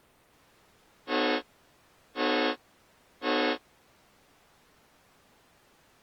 Train horn signal, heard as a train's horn. 3 short. On North American railways: when stopped, the train will back up.